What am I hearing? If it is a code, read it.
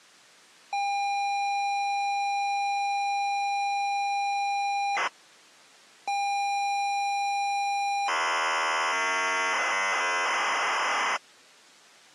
ZX Spectrum tape loading, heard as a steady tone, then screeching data.